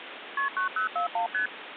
Multi-frequency trunk signalling (R1, as on North American trunks), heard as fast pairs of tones, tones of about 110 ms, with phone line noise. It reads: KP 9041 ST